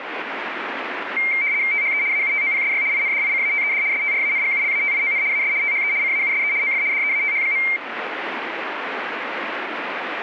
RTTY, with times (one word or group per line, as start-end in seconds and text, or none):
1.7-2.0 THE
2.1-2.8 AUTOPSY
2.9-3.8 INDICATED
3.9-5.2 STRANGULATION
5.3-5.5 AS
5.6-5.9 THE
6.0-6.5 CAUSE
6.6-6.8 OF
6.9-7.6 DEATH.